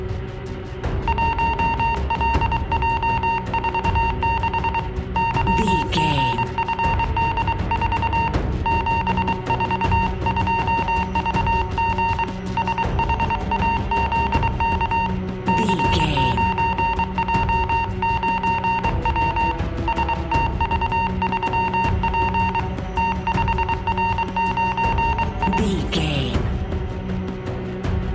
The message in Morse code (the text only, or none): 1LJ46 YGFD4 742VG SHAZK C9J9W STV3P T5R9I